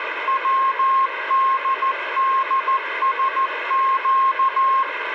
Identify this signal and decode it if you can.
Morse code, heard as a keyed tone, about 14 wpm, 1070 Hz, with radio static. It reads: WDDSQ